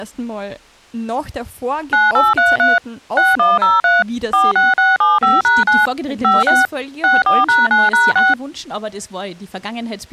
DTMF, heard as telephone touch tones, dialled by machine, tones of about 180 ms. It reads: 9833 6103 46675#9 56 64#9#6